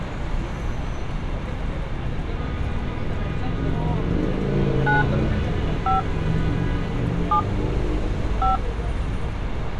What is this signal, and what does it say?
DTMF, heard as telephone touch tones, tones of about 140 ms, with street noise. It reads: 9 5 7 5